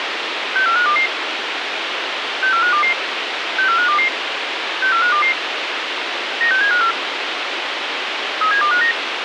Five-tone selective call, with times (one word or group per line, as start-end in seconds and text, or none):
0.6-1.1 64522
2.4-2.9 64522
3.6-4.1 64522
4.8-5.3 64522
6.4-6.9 96754
8.4-8.9 37259